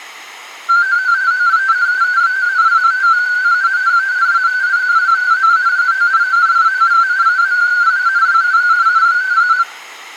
Multi-tone FSK (Olivia or MFSK type), about 250 Hz wide, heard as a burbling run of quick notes, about 31.25 baud, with room echo.